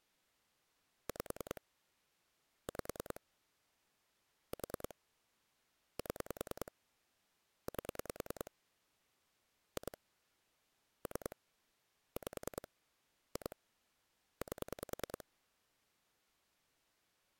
Pulse dialling, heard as clicks on a phone line, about 10 pulses a second. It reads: 5 5 4 7 8 2 3 5 2 8